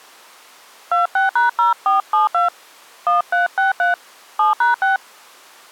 DTMF, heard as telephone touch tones, dialled by hand, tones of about 140 ms. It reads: 26#0472 1363 7#6